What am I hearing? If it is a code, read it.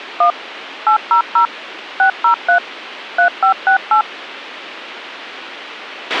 DTMF, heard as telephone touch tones, dialled by machine, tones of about 100 ms, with a squelch burst at the end. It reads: 1 800 603 3568